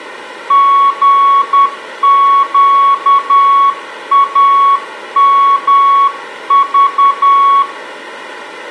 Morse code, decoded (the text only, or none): GQAMV